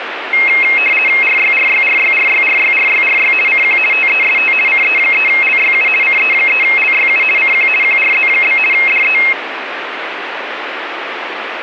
RTTY (50 baud, 450 Hz shift), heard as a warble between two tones, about 2350 Hz centre, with radio static. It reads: RYRYRYRYRYRYRY CQ TEST CE3LYU CE3LYU CQ QRZ? DE